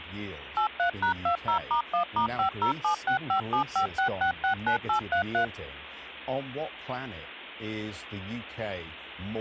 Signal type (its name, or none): DTMF